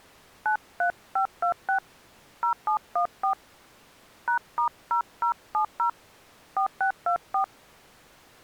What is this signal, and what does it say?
DTMF, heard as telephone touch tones, dialled by hand, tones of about 100 ms. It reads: 93526 0714 #*0070 4624